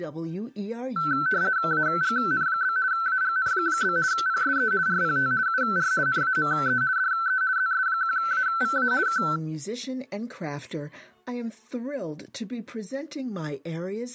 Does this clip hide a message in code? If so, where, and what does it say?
Yes: RTTY (50 baud, 170 Hz shift) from 1.0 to 9.4 s, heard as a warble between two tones, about 1430 Hz centre. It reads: AGN? AGN? PSE RPT UR NAME DE ZS1AVA K